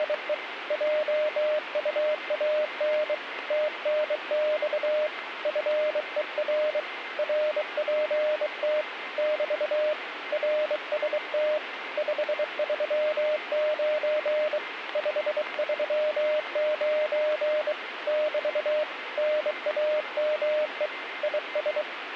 Morse code, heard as a keyed tone, hand-sent with a bug key, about 23 wpm, 610 Hz, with radio static and a weaker station near 2080 Hz. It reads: … JUAN TNX FER RPT <BT> RST 539 539 <BT> NAME IS